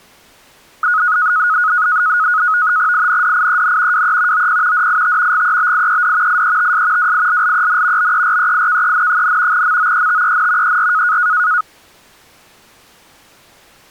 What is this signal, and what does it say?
NAVTEX (SITOR-B), 100 baud, 170 Hz shift, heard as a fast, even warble, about 1360 Hz centre. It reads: INDIEN WE OP DIT GEBIED IETS WILLEN BEREIKEN, MOETEN ER